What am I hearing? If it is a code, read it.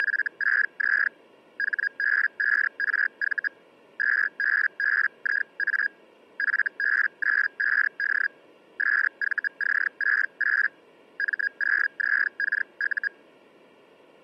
Hellschreiber (Feld-Hell, 122.5 baud), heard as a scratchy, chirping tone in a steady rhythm, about 1650 Hz. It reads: … HB5RV 2BBIA FB95D SVC68 M0ZKU